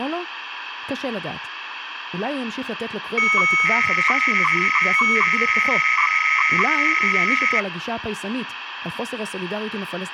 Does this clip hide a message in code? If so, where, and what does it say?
Yes: 300-baud modem data (Bell 103 tones) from 3.2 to 7.6 s, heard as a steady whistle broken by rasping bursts, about 300 baud, 200 Hz shift, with phone line noise and speech in Hebrew.